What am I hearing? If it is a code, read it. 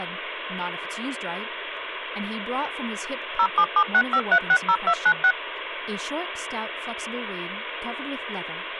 DTMF, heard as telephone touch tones, dialled by machine, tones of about 70 ms, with phone line noise and speech in English. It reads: 07765360296